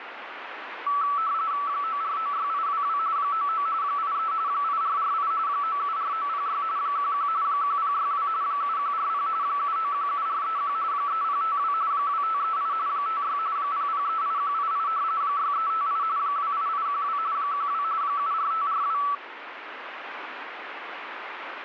RTTY (45.45 baud, 170 Hz shift), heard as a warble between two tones, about 1230 Hz centre, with radio static. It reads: 9496822 99 83 8448 974906 11 1062 7140 7917431 3052 2538 56 0038188 6358 28812 12 74542